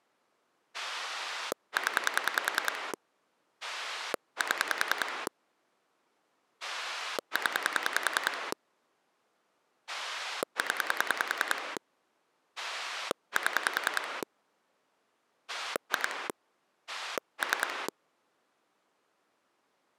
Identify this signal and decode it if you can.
Pulse dialling, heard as a rotary dial, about 10 pulses a second. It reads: 0 7 0 0 7 2 3